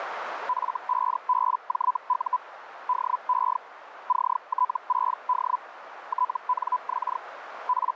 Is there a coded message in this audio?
Yes: Hellschreiber (Feld-Hell, 122.5 baud) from 0.5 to 8.0 s, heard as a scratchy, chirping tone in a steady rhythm, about 1000 Hz, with radio static and a narrow filter. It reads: F5BJU DE CT6D TNX …